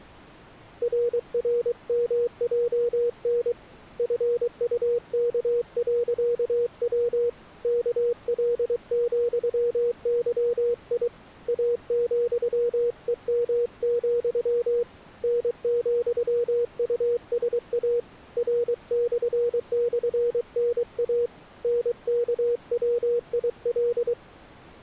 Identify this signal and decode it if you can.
Morse code, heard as a keyed tone, hand-sent with a paddle, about 23 wpm, 480 Hz. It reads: RRMJN FUK.W KL,YI A,EM, N,USA R//NA NKWIL